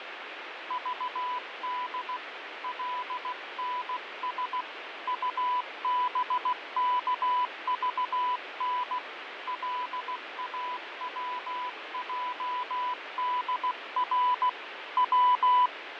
Morse code, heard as a keyed tone, hand-sent with a paddle, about 16 wpm, 990 Hz, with radio static and fading. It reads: VD LNS UBKVN LAWJDR W